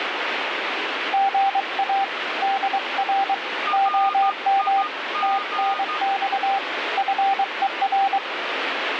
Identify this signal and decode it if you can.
Morse code, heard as two keyed tones, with radio static. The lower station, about 23 wpm, 780 Hz: GA DR OM TNX FER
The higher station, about 13 wpm, 1220 Hz: RIG